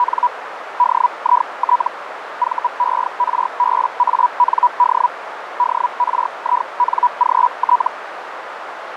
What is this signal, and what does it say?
Hellschreiber (Feld-Hell, 122.5 baud), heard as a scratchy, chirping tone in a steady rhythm, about 980 Hz, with radio static and a narrow filter. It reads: … DIT VERBAND DRINGT